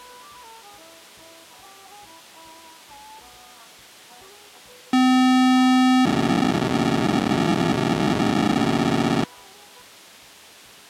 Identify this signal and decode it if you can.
POCSAG pager data (512 baud), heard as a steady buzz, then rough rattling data.